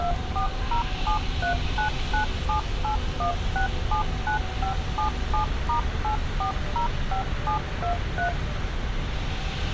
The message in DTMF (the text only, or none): 2407399781679577*8405723